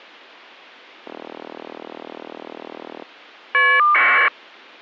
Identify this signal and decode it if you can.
Caller ID data burst, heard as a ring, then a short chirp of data, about 1200 baud.